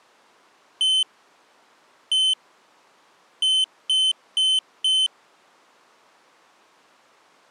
Beep code, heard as a piezo beeper, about 3050 Hz. 1-1-4. In Phoenix BIOS tables: BIOS ROM checksum failure.